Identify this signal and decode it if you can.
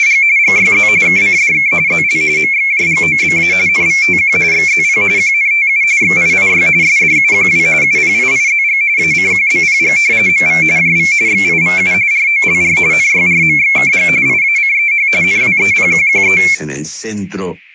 RTTY (45.45 baud, 170 Hz shift), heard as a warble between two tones, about 2250 Hz centre. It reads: … GYZ KCDK ZL MXJGOBA NVTQ XZP QNTU XIIY SDUQW UPIIZG ACQBPG MV JV XIVU ROLR NYRMXKG IACEH NWEPQQE